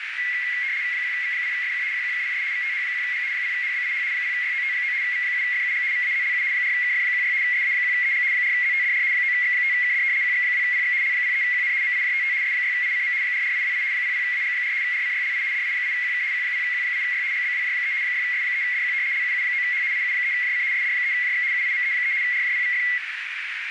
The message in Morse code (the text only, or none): none